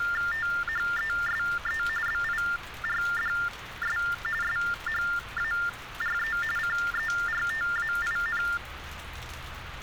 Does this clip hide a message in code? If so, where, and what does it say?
Yes: TTY/TDD text telephone tones (45.45 baud Baudot) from 0.0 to 8.6 s, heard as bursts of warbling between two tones, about 400 Hz shift, 1600 Hz centre, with phone line noise and street noise. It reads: THESE BIRDS SHARE CERTAIN